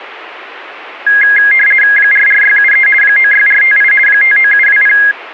RTTY (50 baud, 450 Hz shift), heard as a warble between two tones, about 1900 Hz centre. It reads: 44673 96458 59720